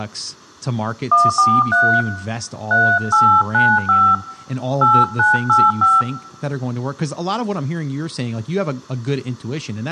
DTMF, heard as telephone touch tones, dialled by hand, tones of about 220 ms, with room echo and speech in English. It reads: 143 3895 8985